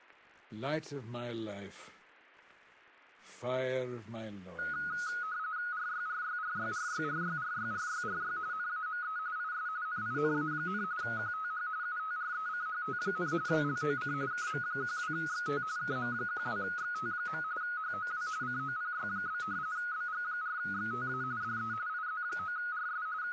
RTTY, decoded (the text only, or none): RYRYRYRYRYRYRYRY NAME IS NINA, QTH UTRECHT, LOC KM12XT KM12XT. HOW COPY? BG4XTA DE IZ9RS …